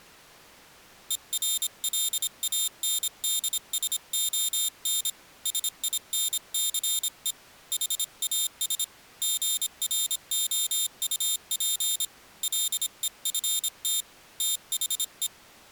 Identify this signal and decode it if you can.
Morse code, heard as a high beeper, hand-sent with a paddle, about 26 wpm, 3650 Hz. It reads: ERLANDSON SINCE HAS GROUP LEFT THE